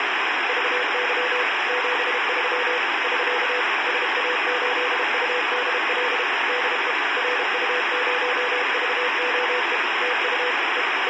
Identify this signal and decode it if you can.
Morse code, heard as a keyed tone, machine-sent, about 32 wpm, 500 Hz, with heavy radio static. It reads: VY 73 <SK> SA8UDL DE RU0VOE TU E …